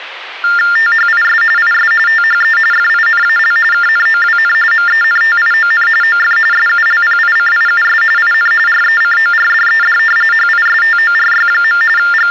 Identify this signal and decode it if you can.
TTY/TDD text telephone tones (45.45 baud Baudot), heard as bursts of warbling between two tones, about 400 Hz shift, 1600 Hz centre, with phone line noise. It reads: THIS IS THE FINAL KNOWN MENTION OF SULPICIUS IN RECORDED HISTORY. …